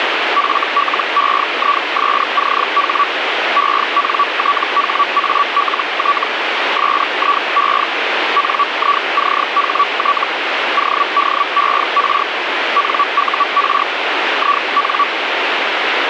Hellschreiber (Feld-Hell, 122.5 baud), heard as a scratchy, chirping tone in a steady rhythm, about 1140 Hz, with radio static. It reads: FLEISCH ENTHALT SIE NICHT ODER NUR IN